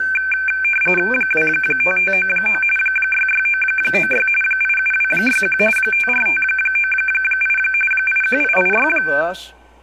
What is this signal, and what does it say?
RTTY (45.45 baud, 850 Hz shift), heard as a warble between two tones, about 1950 Hz centre, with speech in English. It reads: 25599 66996 87261 54598 81886